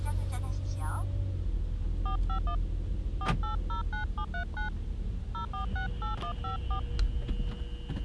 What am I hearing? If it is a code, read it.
DTMF, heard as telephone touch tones, dialled by hand, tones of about 100 ms, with the noise inside a car. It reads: 451 4809739 0468154